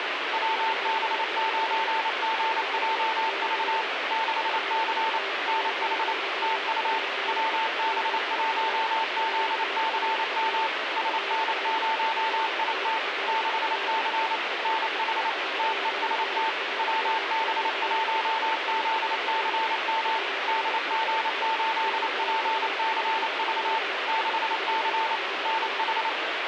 Morse code, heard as a keyed tone, machine-sent, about 28 wpm, 890 Hz, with radio static. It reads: WB9GJV 6C NH TU WB1ZCM SN0IT 6C NH TEST WB1ZCM DG8PCV 6C NH